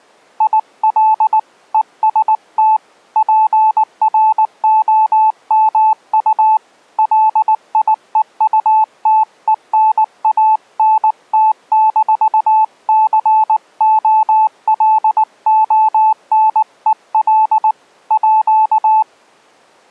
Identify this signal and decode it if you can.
Morse code (with French letters), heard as a keyed tone, hand-sent with a paddle, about 19 wpm, 870 Hz. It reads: IL EST PROMU LIEUTENANT-COLONEL À